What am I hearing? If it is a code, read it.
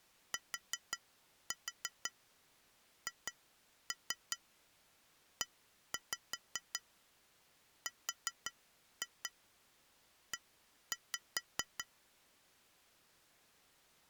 Tap code, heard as taps on glass, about 5 knocks a second. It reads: THERE